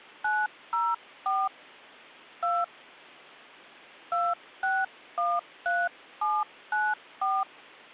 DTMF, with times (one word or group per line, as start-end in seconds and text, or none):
0.2-1.5 904
2.4-2.6 2
4.1-7.4 2613794